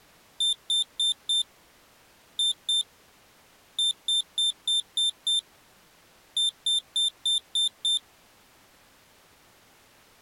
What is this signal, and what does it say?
Beep code, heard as a piezo beeper, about 3600 Hz. 4-2-6-6.